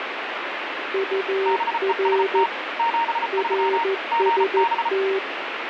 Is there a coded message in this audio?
Yes: Morse code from 0.9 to 5.2 s, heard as two keyed tones, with radio static. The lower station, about 14 wpm, 390 Hz: UR RST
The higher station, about 34 wpm, 930 Hz: BEST 73 GB